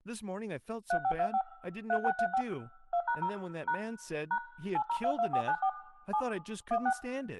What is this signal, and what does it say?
DTMF, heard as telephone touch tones, dialled by machine, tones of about 80 ms, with room echo and speech in English. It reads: 3525 3635 2#0 # # 8022494 7 16